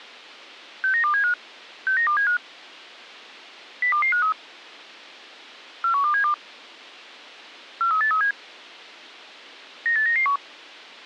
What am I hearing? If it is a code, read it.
Five-tone selective call (CCIR), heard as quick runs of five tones, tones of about 100 ms. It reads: 69275 69275 02253 41272 43837 98991